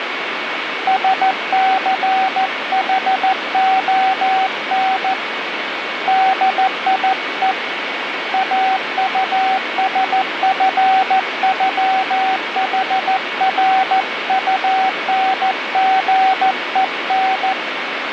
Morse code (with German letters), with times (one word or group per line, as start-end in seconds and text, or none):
0.9-5.1 SCHON
6.1-7.5 DIE
8.3-17.5 AUSFÜHRUNGEN